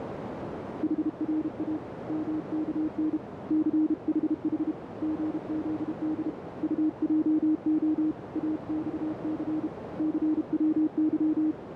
Morse code, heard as a keyed tone, hand-sent with a bug key, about 32 wpm, 310 Hz, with heavy radio static and a narrow filter. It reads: HRA MKN CHH GZD UJO AXC CWY